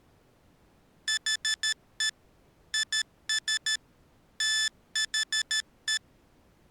Morse code, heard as electronic beeps, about 13 wpm, 1750 Hz. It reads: HE IS THE